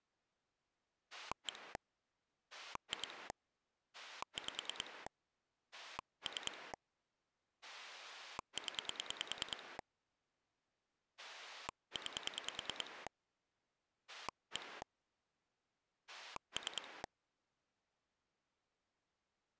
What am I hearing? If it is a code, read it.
Pulse dialling, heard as a rotary dial, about 10 pulses a second. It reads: 1 2 5 3 0 9 1 3